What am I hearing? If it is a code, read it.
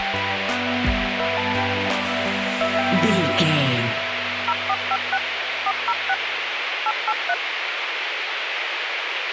DTMF, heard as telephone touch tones, dialled by machine, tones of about 50 ms, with radio hiss. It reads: 0456 406 883